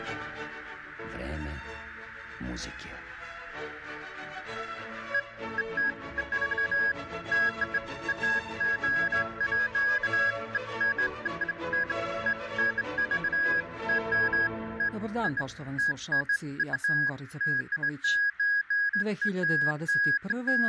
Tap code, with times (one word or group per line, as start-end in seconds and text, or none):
none